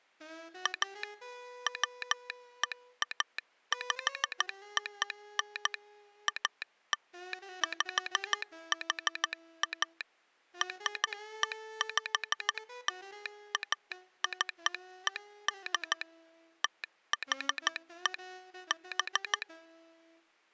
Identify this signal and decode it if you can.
Morse code (American railroad code), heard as a telegraph sounder, hand-sent with a straight key. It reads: A WEAPON ALPHA REPLACED THE B